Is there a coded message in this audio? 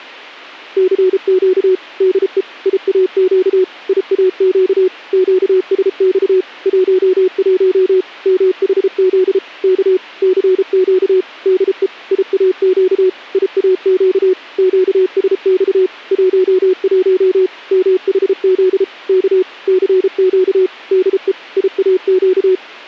Yes: Morse code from 0.7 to 22.6 s, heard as a keyed tone, machine-sent, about 33 wpm, 370 Hz. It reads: CQ DE IAQ IAQ QSX 11 MHZ K CQ DE IAQ IAQ QSX 11 MHZ K CQ DE IAQ